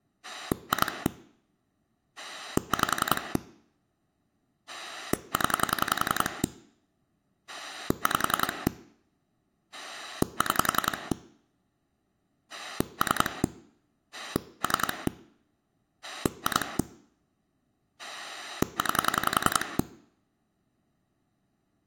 Pulse dialling, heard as a rotary dial, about 10 pulses a second. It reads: 2 5 0 5 6 3 3 2 9